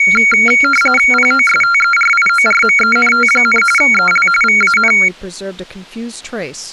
RTTY (45.45 baud, 850 Hz shift), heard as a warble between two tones, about 1800 Hz centre, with speech in English. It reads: POSTERIORMENT, EL VAN